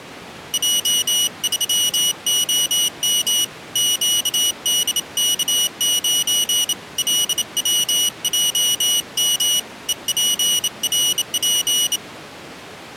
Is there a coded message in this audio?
Yes: Morse code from 0.5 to 12.0 s, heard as a high beeper, hand-sent with a bug key, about 28 wpm, 2950 Hz. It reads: J3OM QDK9 LWJM EPRP